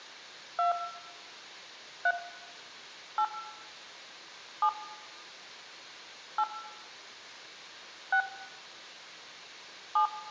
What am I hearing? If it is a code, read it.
DTMF, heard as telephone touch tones, dialled by hand, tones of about 100 ms, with room echo. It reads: 2 3 8 7 8 6 7